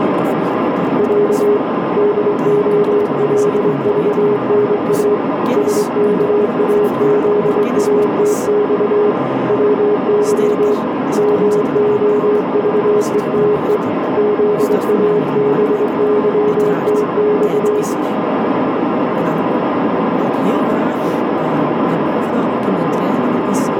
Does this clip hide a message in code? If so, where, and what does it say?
Yes: Morse code (Russian alphabet) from 0.9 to 17.9 s, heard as a keyed tone, hand-sent with a straight key, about 23 wpm, 420 Hz, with heavy radio static, a narrow filter, room echo and speech in Dutch. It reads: Я ДОЛЖНА СКАЗАТЬ ВЫ МОЖЕТЕ ЗАБЫТЬ